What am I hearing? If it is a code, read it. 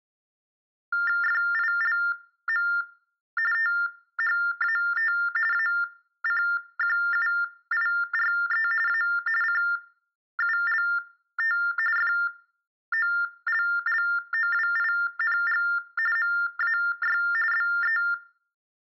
TTY/TDD text telephone tones (45.45 baud Baudot), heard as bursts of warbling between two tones, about 400 Hz shift, 1600 Hz centre. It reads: FILM THAT ACQUIRE A CULT FOLLOWING MAY BE